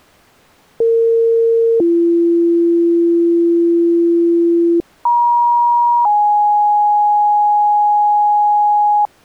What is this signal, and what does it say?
Two-tone page, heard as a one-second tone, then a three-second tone, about 460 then 340 Hz, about 950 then 830 Hz.